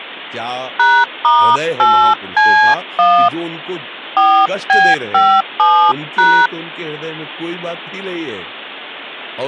DTMF, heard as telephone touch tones, dialled by hand, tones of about 300 ms, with speech in Hindi. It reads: #*8C1 4B57#